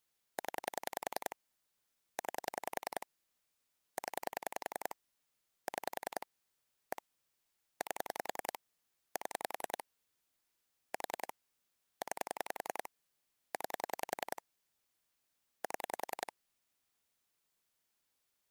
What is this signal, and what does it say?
Pulse dialling, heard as clicks on a phone line, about 10 pulses a second. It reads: 0 9 0 6 1 8 7 4 9 9 7